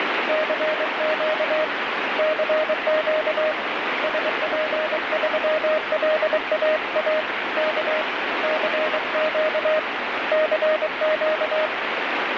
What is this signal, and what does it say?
Morse code, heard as a keyed tone, hand-sent with a paddle, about 23 wpm, 620 Hz, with heavy radio static. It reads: CQ CQ SP3LAA K CQ CQ